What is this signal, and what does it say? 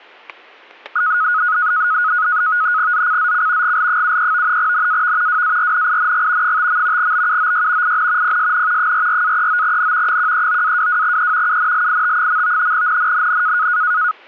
NAVTEX (SITOR-B), 100 baud, 170 Hz shift, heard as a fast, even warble, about 1360 Hz centre, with static crashes. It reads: ZCZC GL73 NAV WARNING 5. BUOY IN PSN 44-39N 139-22E UNLIT. NNNN